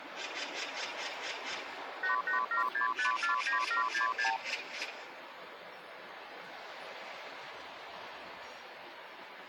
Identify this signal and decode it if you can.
Multi-frequency trunk signalling (R2, with the far end's replies), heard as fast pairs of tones, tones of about 120 ms, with the noise of a park. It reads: 8876549766